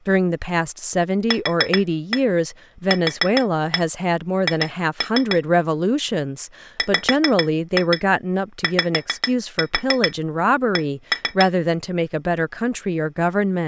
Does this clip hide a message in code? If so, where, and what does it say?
Yes: tap code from 1.3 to 11.5 s, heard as taps on glass, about 7 knocks a second, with speech in English. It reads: QQH WYC